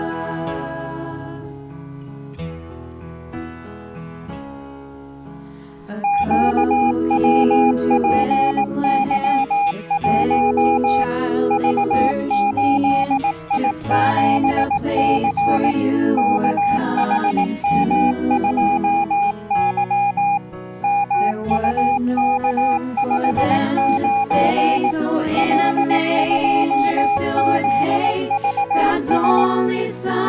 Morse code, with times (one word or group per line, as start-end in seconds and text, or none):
6.0-11.0 QWPY1
11.5-15.7 V8I7C
16.2-20.4 KHM2Y
20.8-24.9 MUK59
25.4-29.4 L2ZVS